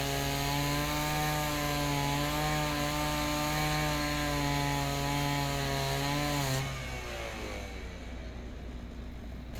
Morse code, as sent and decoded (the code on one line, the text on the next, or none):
none